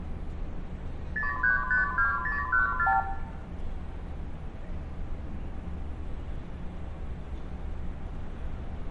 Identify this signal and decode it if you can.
Multi-frequency trunk signalling (R2, with the far end's replies), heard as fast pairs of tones, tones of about 140 ms, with room echo and street noise. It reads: 0352014